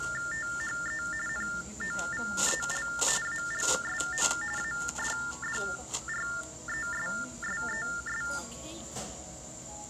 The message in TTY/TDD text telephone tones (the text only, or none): THE NOVEL ALSO ADDRESSES